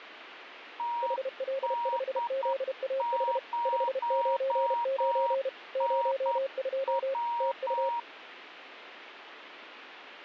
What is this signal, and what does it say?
Morse code, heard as two keyed tones, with radio static. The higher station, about 9 wpm, 950 Hz: TD0NW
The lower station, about 32 wpm, 540 Hz: HL5ZAH 599 02 TU